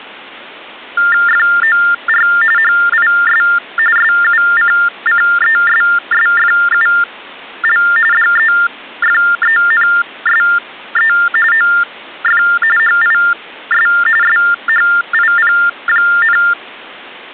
TTY/TDD text telephone tones (45.45 baud Baudot), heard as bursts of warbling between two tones, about 400 Hz shift, 1600 Hz centre. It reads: FOR HIS SUCCESSFUL DEFENSE OF HIS SHIP,